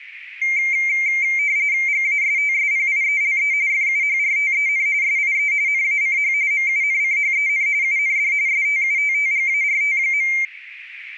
RTTY (45.45 baud, 170 Hz shift), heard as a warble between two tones, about 2200 Hz centre, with radio static. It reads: GASTSPIELE FUHRTEN SIE NACH MUNCHEN UND STUTTGART.